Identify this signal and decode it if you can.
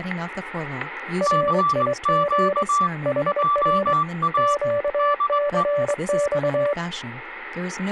Morse code, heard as two keyed tones, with static crashes and speech in English. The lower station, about 23 wpm, 580 Hz: RIG HR QCX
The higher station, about 19 wpm, 1160 Hz: CQ JA DE